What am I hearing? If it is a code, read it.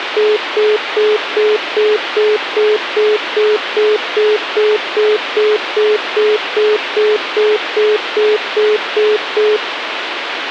Telephone call progress tone (single-tone plan, as in most of Europe), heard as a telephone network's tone, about 420 Hz, 0.2 s on and 0.2 s off, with phone line noise. Congestion tone.